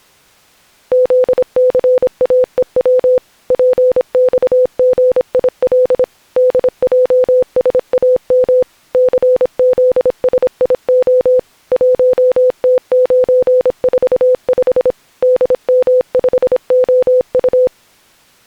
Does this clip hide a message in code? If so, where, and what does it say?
Yes: Morse code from 0.9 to 17.7 s, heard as a keyed tone, machine-sent, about 26 wpm, 510 Hz. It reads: ZCAEW PXGIL DJSAM CZSIO 1T945 DM5OU